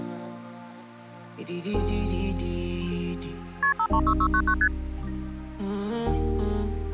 Multi-frequency trunk signalling (R1, as on North American trunks), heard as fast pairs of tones, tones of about 70 ms. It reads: KP 536699 ST